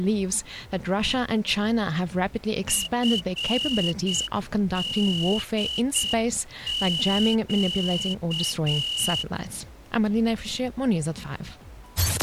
Morse code, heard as a whistle, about 7 wpm. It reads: FDQ